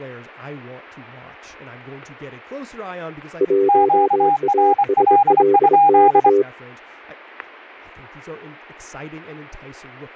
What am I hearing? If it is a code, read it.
Morse code, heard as two keyed tones, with static crashes and speech in English. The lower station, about 23 wpm, 400 Hz: 1ASLK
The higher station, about 25 wpm, 810 Hz: QRL?